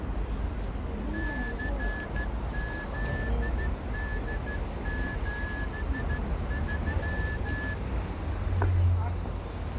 Morse code, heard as a whistle, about 14 wpm, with street noise. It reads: CZD73